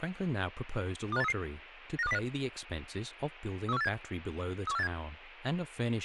Five-tone selective call (EEA), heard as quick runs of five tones, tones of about 40 ms, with speech in English. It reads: 25833 95205 31487 31487